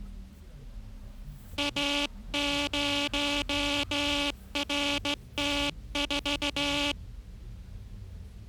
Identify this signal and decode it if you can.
Morse code, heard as a buzzer, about 15 wpm, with the noise inside a car. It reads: A0RT4